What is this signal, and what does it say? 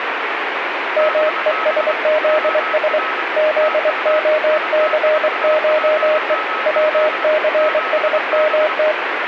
Morse code (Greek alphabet), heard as a keyed tone, hand-sent with a straight key, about 24 wpm, 620 Hz, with radio static and a weaker station near 1290 Hz. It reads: ΜΕΣΖΣ ΖΟΘΧΕ ΩΘΣΜΤ